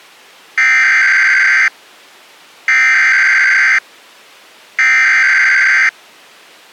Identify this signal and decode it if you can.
Emergency Alert System (SAME) tones (header bursts), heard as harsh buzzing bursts, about 520.83 baud.